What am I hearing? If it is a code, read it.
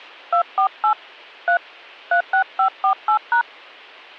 DTMF, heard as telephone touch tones, dialled by hand, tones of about 90 ms. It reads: 248 3 36548#